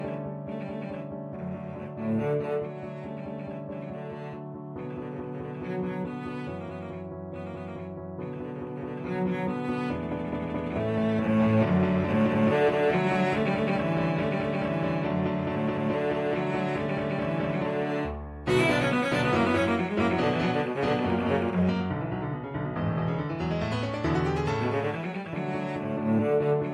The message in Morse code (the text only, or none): none